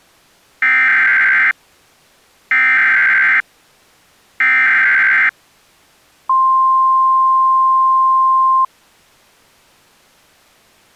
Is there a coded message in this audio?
Yes: Emergency Alert System (SAME) tones (header bursts, then the 1050 Hz attention tone) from 0.6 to 8.6 s, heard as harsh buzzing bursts, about 520.83 baud.